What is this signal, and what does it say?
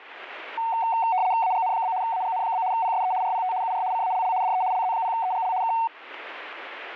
RTTY (75 baud, 170 Hz shift), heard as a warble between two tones, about 820 Hz centre, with radio static. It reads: AGN? AGN? PSE RPT UR CALL DE LZ0EGL K